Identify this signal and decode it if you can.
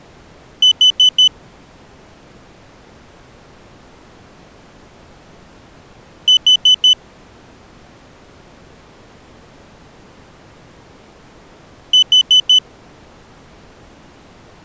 Alarm pattern, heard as an alarm's beeps, played three times, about 3000 Hz. Temporal four. Carbon monoxide.